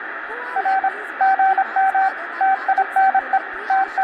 Morse code, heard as a keyed tone, machine-sent, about 26 wpm, 770 Hz, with radio static, room echo and speech in Gujarati. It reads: R GM TINE …